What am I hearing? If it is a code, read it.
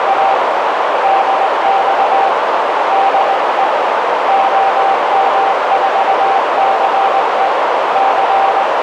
Morse code, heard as a keyed tone, hand-sent with a straight key, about 19 wpm, 780 Hz, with heavy radio static and a narrow filter. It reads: … DX DE OM4CE …